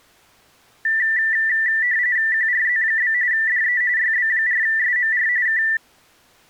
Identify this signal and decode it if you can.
RTTY (45.45 baud, 170 Hz shift), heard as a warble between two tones, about 1850 Hz centre. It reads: QRZ? DE YB4SMR K